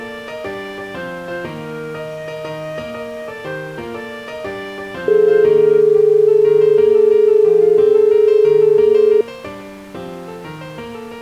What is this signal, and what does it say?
Telephone call progress tone (as in Australia), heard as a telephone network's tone, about 430 Hz. Dial tone.